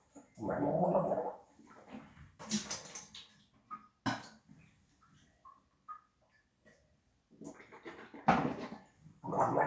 The noise of a restroom. There is no code.